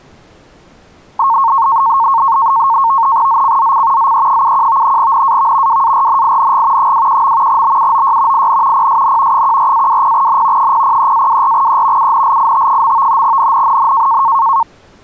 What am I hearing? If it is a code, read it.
NAVTEX (SITOR-B), 100 baud, 170 Hz shift, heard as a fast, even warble, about 1000 Hz centre. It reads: ZCZC ZE71 NAV WARNING 21. BUOY IN PSN 14-20N 003-24E UNLIT. NNNN